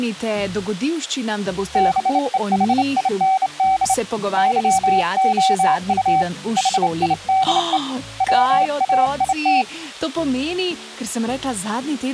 Morse code, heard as a keyed tone, hand-sent with a straight key, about 28 wpm, 760 Hz. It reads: BEHIND YOU HIDE WAIT